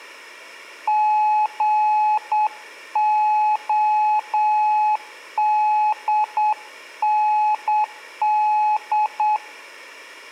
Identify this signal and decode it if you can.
Morse code, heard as a keyed tone, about 8 wpm, 850 Hz, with room echo. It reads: GODND